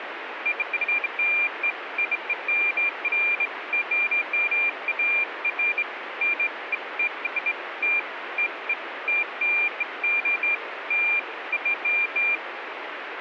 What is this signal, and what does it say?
Beeps of irregular length, with radio static. There is no code.